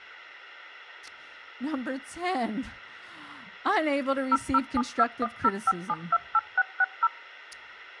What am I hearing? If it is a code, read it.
DTMF, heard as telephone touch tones, dialled by machine, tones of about 40 ms, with speech in English. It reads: 0072105728660